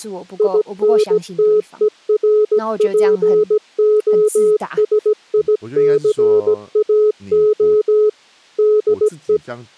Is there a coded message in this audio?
Yes: Morse code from 0.3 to 9.4 s, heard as a keyed tone, machine-sent, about 17 wpm, 420 Hz, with speech in Chinese. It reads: INTERPOSICAO DE